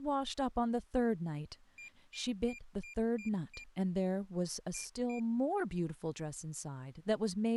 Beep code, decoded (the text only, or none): 6-2